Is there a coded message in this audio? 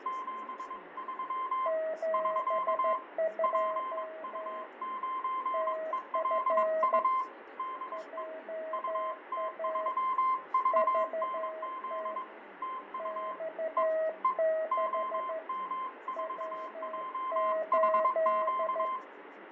Yes: Morse code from 0.0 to 19.0 s, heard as two keyed tones, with radio static, fading and speech in Russian. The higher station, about 22 wpm, 1040 Hz: 73 <SK> PU9ELU DE UT3VNZ TU E E OM4JHQ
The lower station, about 13 wpm, 640 Hz: 72 TF JA VT X6 W8